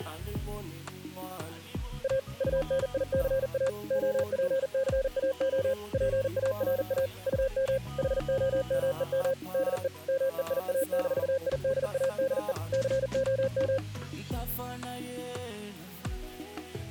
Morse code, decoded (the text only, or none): A UNICA OPCAO PARA UM HOMEM DE MEIA-IDADE COM